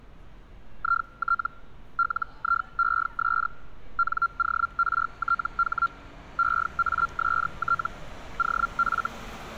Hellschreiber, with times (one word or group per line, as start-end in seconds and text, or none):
0.8-1.5 IT
2.0-3.5 LIES
4.0-5.9 NORTH
6.4-7.9 EAST
8.4-9.1 OF